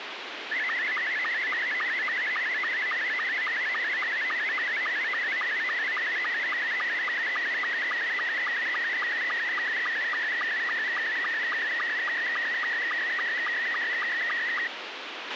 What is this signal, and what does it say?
SSTV (slow-scan television), Scottie S2, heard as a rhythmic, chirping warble, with radio hiss and a squelch burst at the end.